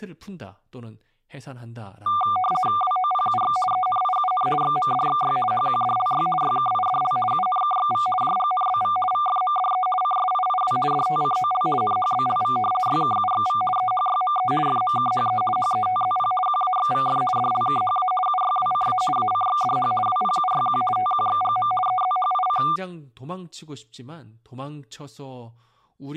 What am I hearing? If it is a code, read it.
RTTY (50 baud, 450 Hz shift), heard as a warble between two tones, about 960 Hz centre, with speech in Korean. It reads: WOPUX ENIUN XMDXY HQDLY YKIDL UNKXV JGNBV VFMDE CSIIW DTCOL NHBLV YKUXV EHYME FMKHE HETZP QAXVF DLKHA UYWCA ACXDH WPUYQ TQXGM EZHIC